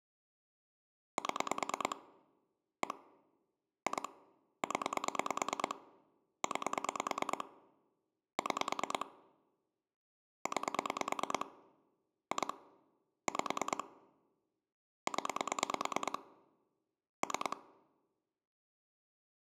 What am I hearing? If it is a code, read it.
Pulse dialling, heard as clicks on a phone line, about 9 pulses a second, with room echo. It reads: 7 1 2 0 9 6 9 2 5 0 3